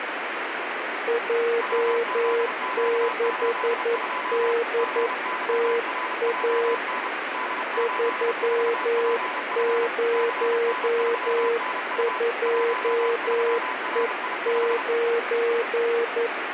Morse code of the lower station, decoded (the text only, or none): J6DTA 302E9